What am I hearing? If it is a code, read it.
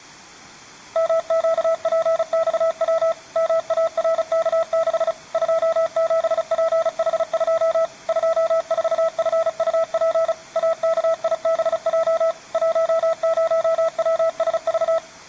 Morse code, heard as a keyed tone, machine-sent, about 35 wpm, 660 Hz. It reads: MQPXW MARK6 27PH2 24FUP AKIBJ 10WSV